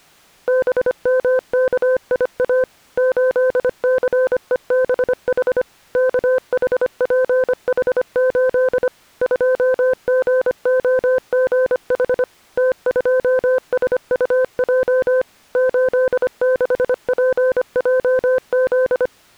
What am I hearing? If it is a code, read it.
Morse code, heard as a keyed tone, machine-sent, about 25 wpm, 510 Hz. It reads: BMKIA 8CEBH KHPH8 2GOGH T2SUJ 86PJZ